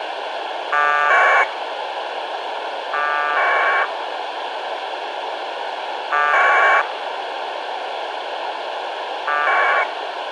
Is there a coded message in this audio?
Yes: packet radio (AX.25, as in APRS), 1200 baud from 0.7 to 9.8 s, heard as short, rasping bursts, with radio hiss.